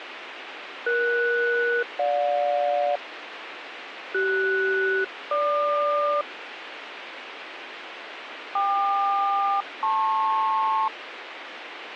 Aircraft SELCAL, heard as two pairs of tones, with radio hiss and a squelch burst at the end. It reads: ES-GJ CS-GQ KQ-LP